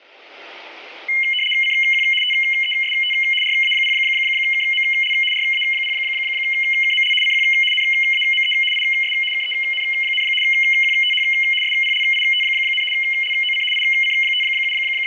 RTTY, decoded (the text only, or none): CQ TEST RA0KML RA0KML CQ NAME IS KEN, QTH SPLIT, LOC …